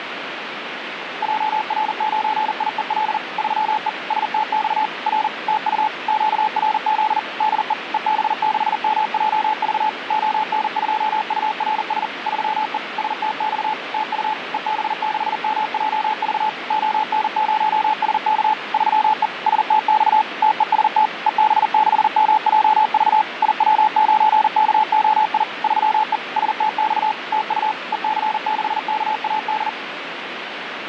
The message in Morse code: JR9IEL 3E STX R TU QRZ DE EB6MJV ON2URS 3E STX TU EB6MJV ON0SK 3E STX TEST EB6MJV IW9KOI 3E STX TU EC6KAD

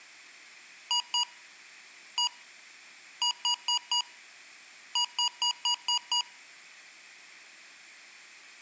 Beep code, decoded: 2-1-4-6

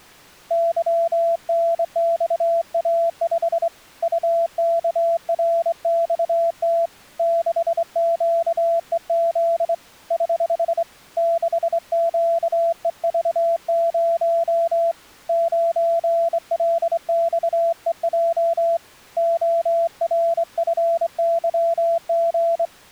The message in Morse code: YNXA5 UKRXT 6QEZ <HH> 6QEV0 9LXEJ ORFYG

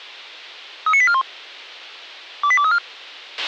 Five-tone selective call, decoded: 39841 28234

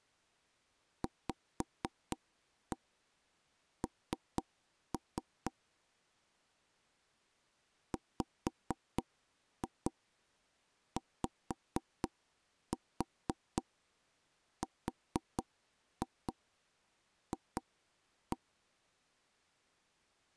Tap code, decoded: VN WYRF

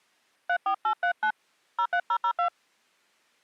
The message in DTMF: 34839 03002

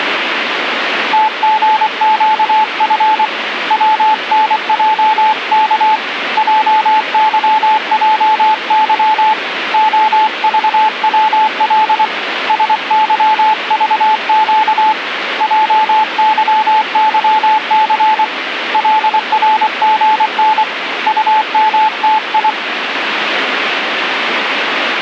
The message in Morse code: TGQF WNJK JYJY OVWL SYVQ JYYC LRGN UMTI

